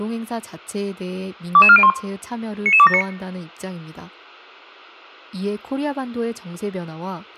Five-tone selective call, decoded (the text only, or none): 22401 99279